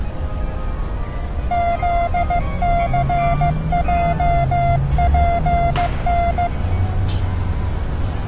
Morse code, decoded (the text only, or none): ZCJPN